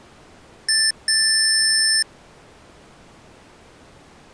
Beep code, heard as beeps from a small speaker, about 1750 Hz. 1 short, 1 long.